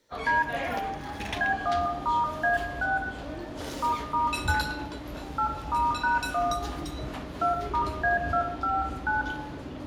DTMF, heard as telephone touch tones, dialled by hand, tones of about 150 ms, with room echo and the noise of a restaurant. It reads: D B1*A6 **9 8*#1 2*A259